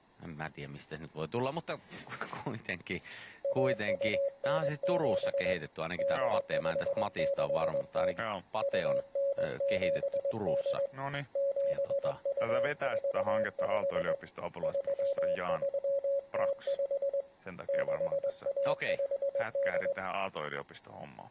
Morse code (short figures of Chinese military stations), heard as a keyed tone, hand-sent with a straight key, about 21 wpm, 560 Hz, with speech in Finnish. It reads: 1297 8560 2978 7245 3305 6158